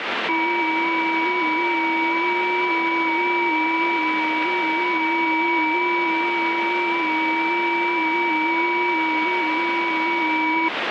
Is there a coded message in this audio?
Yes: FT8 (several signals at once) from 0.3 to 10.7 s, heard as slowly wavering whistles, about 6.25 baud, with heavy radio static.